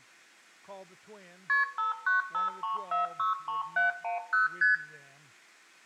Multi-frequency trunk signalling (R1, as on North American trunks), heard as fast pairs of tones, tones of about 140 ms, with room echo. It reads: KP 5953463710 ST